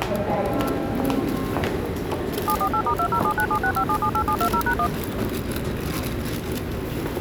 DTMF, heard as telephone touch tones, dialled by machine, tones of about 80 ms, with the noise of a subway station. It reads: 748*2079765778720#1